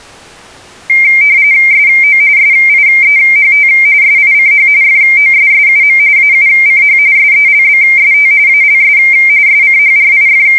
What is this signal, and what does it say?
RTTY (45.45 baud, 170 Hz shift), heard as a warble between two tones, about 2200 Hz centre. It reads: SO SIEHT SICH FOSSUM AUCH SELBST ALS …